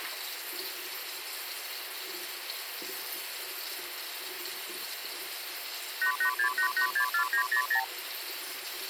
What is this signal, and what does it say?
Multi-frequency trunk signalling (R2, with the far end's replies), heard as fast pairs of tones, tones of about 90 ms, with phone line noise and the noise of a restroom. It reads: 8868864900